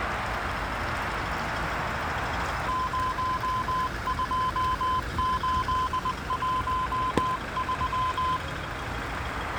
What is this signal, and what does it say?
Morse code, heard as a keyed tone, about 20 wpm, 1020 Hz, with radio static, a narrow filter and the noise of a residential street. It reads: 02813